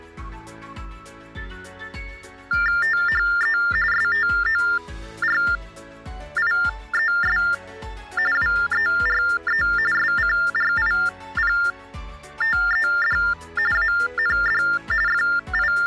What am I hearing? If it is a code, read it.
TTY/TDD text telephone tones (45.45 baud Baudot), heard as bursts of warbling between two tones, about 400 Hz shift, 1600 Hz centre. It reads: THE STORIES WERE SCRIPTED AND …